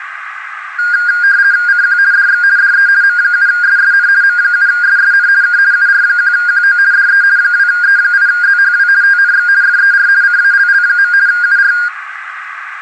RTTY (50 baud, 170 Hz shift), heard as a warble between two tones, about 1500 Hz centre, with radio static, a narrow filter and room echo. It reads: CQ DX DE M7SSN M7SSN K UR1QO DE 2E8ZHW TNX FER CALL. UR